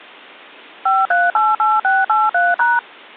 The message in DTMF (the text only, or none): 5388683#